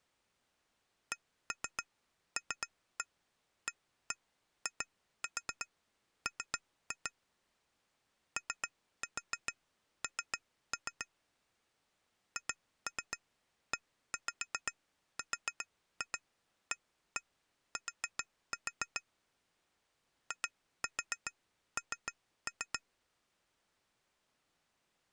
Tap code, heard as taps on glass, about 7 knocks a second. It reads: CLAIM ON HERAT IN